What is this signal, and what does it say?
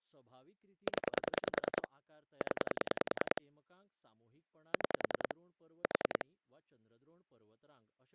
Pulse dialling, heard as clicks on a phone line, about 10 pulses a second, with speech in Goan Konkani. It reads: 0 0 6 4